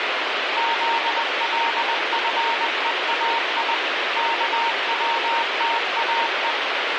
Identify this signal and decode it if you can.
Morse code (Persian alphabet), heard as a keyed tone, machine-sent, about 20 wpm, 920 Hz, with heavy radio static. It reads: زلفهای کوتاه